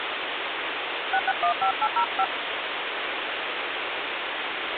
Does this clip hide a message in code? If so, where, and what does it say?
Yes: DTMF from 1.1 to 2.2 s, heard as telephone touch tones, dialled by hand, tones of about 80 ms, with phone line noise. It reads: 6615805